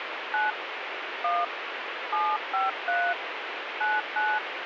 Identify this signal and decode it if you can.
DTMF, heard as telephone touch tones, dialled by hand, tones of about 210 ms, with radio hiss. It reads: 9 1 753 99